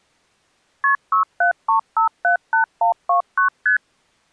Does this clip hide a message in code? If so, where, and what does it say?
Yes: multi-frequency trunk signalling (R1, as on North American trunks) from 0.8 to 3.8 s, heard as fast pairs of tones, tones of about 110 ms. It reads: KP 673578129 ST